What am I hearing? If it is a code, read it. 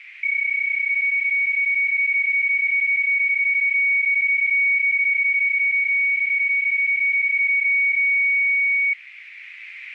PSK31 (31.25 baud), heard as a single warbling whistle, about 2250 Hz, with radio static.